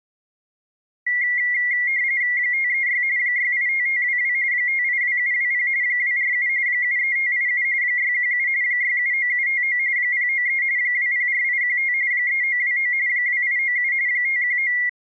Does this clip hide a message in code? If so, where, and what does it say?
Yes: RTTY (45.45 baud, 170 Hz shift) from 1.1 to 14.9 s, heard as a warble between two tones, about 2050 Hz centre. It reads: 536 685522 582720 247 73587 617 679759 093 204815 3929 2897 519